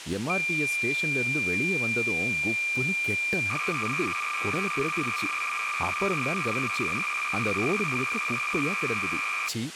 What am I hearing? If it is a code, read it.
Cassette data (Kansas City type), 300 baud, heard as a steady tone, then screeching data, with tape hiss and speech in Tamil.